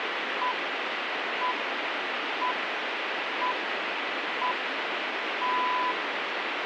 Radio time signal (six pips, as the Greenwich Time Signal), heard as pips, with radio static.